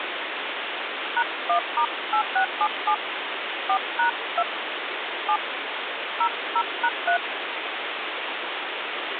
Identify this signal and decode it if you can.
DTMF, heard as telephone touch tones, dialled by hand, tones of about 80 ms, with phone line noise. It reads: #1*8677 4#2 7 00#3